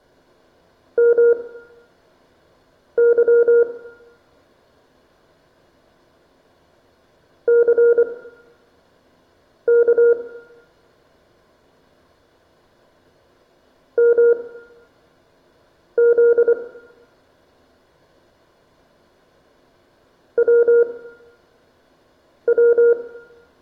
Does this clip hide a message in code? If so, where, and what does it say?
Yes: Morse code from 0.9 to 23.0 s, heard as a keyed tone, machine-sent, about 24 wpm, spaced as for 5 wpm, 470 Hz, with room echo. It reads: MY CK MZ WW